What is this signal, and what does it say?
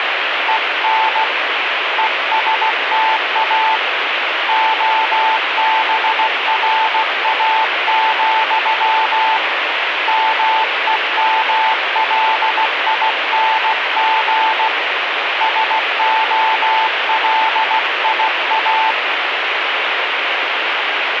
Morse code, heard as a keyed tone, hand-sent with a paddle, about 16 wpm, 880 Hz, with radio static. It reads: EN ESTA OBRA, MEMLING SOLIA